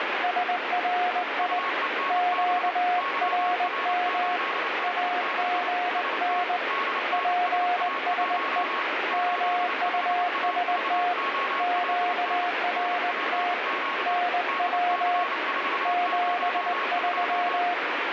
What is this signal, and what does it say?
Morse code, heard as two keyed tones, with heavy radio static. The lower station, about 20 wpm, 710 Hz: SRI QRM AGN PSE MUST QRT NW 73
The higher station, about 29 wpm, 1100 Hz: UENB YR8D6 ST DNSA1 85AVOLN NPQ DC402